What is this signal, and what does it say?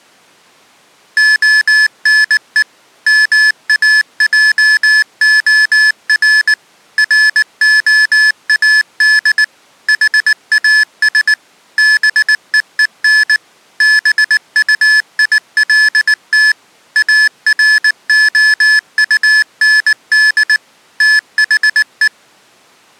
Morse code, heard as electronic beeps, machine-sent, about 19 wpm, 1700 Hz. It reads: ONE MAJOR ROAD HAS BEEN BUILT AROUND THE